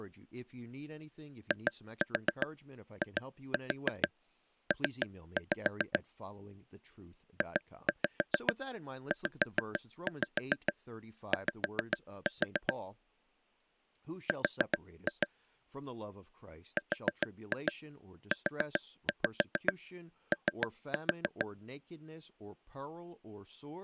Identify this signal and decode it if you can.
Tap code, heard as taps on a table, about 7 knocks a second, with speech in English. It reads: IIP JZY R RUO